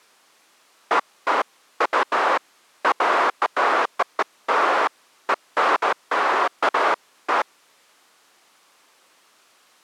Bursts of noise. There is no code.